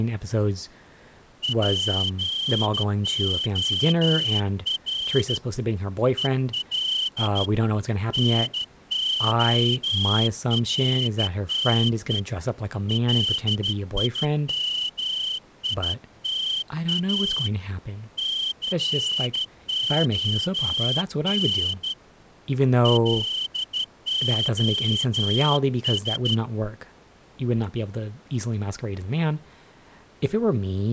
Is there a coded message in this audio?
Yes: Morse code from 1.4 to 26.4 s, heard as a whistle, hand-sent with a straight key, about 13 wpm, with speech in English. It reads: POR EL NORTE LIMITA CON LOS